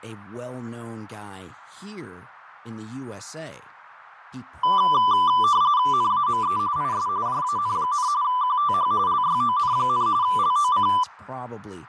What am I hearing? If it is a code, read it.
RTTY (45.45 baud, 170 Hz shift), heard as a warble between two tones, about 1090 Hz centre, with radio static, fading and speech in English. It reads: NAME IS JAN, QTH LYON, LOC